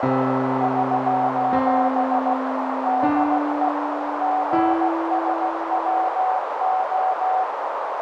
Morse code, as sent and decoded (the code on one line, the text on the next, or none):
...---... / -.. . / --. ... .-- ---
<SOS> DE GSWO